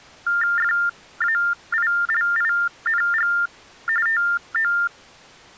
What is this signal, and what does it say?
TTY/TDD text telephone tones (45.45 baud Baudot), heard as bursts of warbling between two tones, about 400 Hz shift, 1600 Hz centre. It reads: FAILING TO